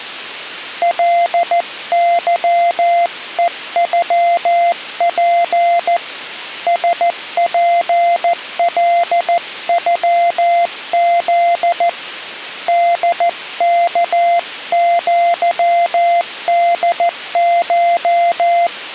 Morse code (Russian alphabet), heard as a keyed tone, hand-sent with a paddle, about 14 wpm, 690 Hz. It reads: ЛЫЕЮП СПЛЮЗ ДКЪДШ